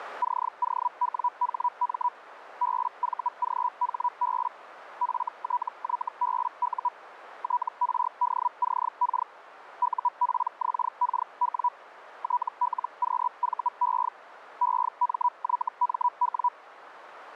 Hellschreiber (Feld-Hell, 122.5 baud), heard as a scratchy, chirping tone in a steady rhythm, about 980 Hz, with radio static and a narrow filter. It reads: COWHM BVGHB FTYBU TRDCK UPXKW TLQVE EMYMW